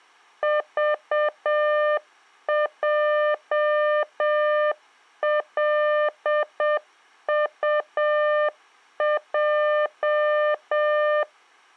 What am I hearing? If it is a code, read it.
Morse code, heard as a keyed tone, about 7 wpm, 600 Hz. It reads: VJLUJ